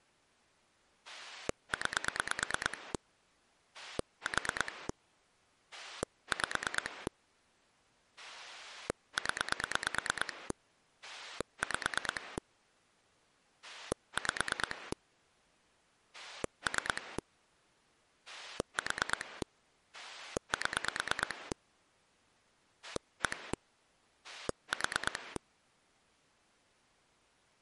Pulse dialling, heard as a rotary dial, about 9 pulses a second. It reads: 9 4 5 0 5 5 3 4 7 1 4